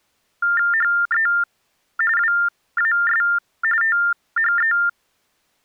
TTY/TDD text telephone tones (45.45 baud Baudot), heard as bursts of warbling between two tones, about 400 Hz shift, 1600 Hz centre. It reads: HE WAS THE